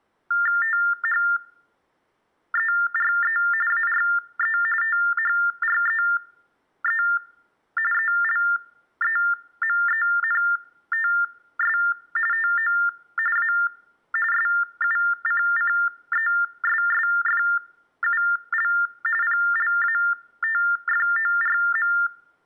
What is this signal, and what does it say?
TTY/TDD text telephone tones (45.45 baud Baudot), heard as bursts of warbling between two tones, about 400 Hz shift, 1600 Hz centre. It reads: THERE ARE THREE ELEMENTS TO A SUCCESSFUL PLATFORM